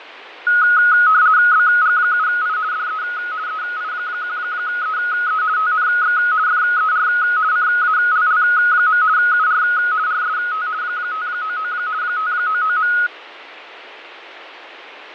RTTY (50 baud, 170 Hz shift), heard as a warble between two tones, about 1360 Hz centre, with radio static and fading. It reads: BG7I DE EI1EE TNX FER CALL. UR RST 599 599.